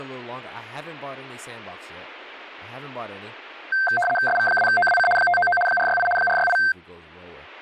RTTY (75 baud, 850 Hz shift), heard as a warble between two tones, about 1130 Hz centre, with speech in English. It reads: SV2OWC 599 468 468